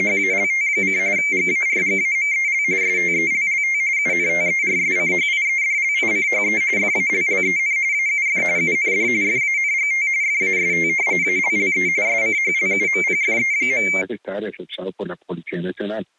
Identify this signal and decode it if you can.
RTTY (45.45 baud, 170 Hz shift), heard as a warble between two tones, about 2200 Hz centre. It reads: … GARGAMEL STELLT UNTERSCHIEDLICHE FALLEN AUF UND FANGT FAST ALLE SCHLUMPFE.